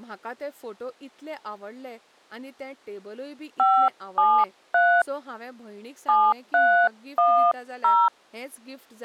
DTMF, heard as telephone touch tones, dialled by hand, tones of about 260 ms, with speech in Goan Konkani. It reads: 573 7310